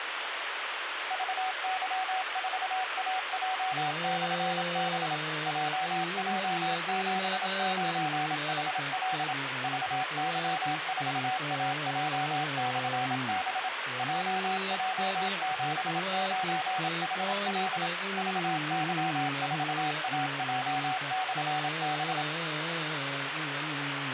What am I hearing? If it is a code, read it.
Morse code, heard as a keyed tone, machine-sent, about 27 wpm, 750 Hz, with radio hiss. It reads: VY4AJ/B JJ79HL VY4AJ/B JJ79HL VY4AJ/B